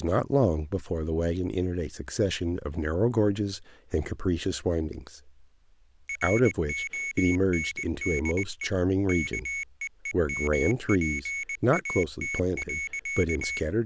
Morse code, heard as a high beeper, machine-sent, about 20 wpm, 2200 Hz, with speech in English. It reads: RONDE KEEMPAT.